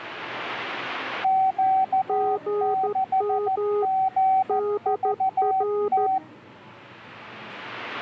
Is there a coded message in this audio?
Yes: Morse code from 1.2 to 6.2 s, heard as two keyed tones, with the noise of a crowd indoors. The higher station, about 14 wpm, 760 Hz: Q6GVT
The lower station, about 13 wpm, 410 Hz: GM DR